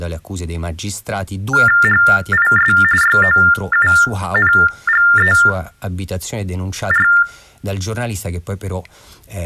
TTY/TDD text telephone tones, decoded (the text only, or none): HIS YOUNGER